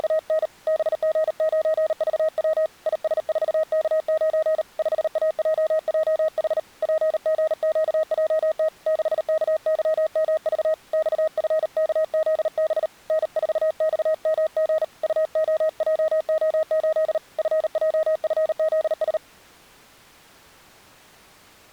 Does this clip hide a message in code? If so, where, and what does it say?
Yes: Morse code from 0.0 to 19.2 s, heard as a keyed tone, hand-sent with a paddle, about 38 wpm, 630 Hz. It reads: … BG9VW IS4K9 5AJJH PGQJT 6KYMV XFKZB N4XMG UOJO8 FJFZS